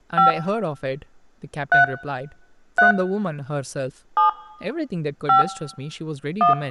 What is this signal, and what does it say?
DTMF, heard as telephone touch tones, dialled by hand, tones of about 130 ms, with speech in English. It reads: 5 3 3 7 5 1